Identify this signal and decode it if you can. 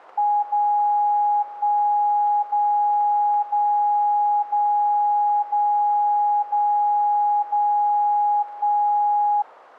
Radio time signal (DCF77), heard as a tone whose level steps once a second, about 830 Hz. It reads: 0 1 0 0 0 0 0 0 1